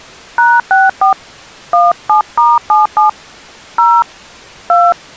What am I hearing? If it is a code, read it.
DTMF, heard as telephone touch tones, dialled by hand, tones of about 200 ms. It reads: #64 17*77 0 2